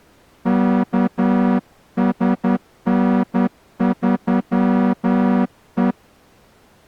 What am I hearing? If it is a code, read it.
Morse code, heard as a horn, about 10 wpm. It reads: KSN3E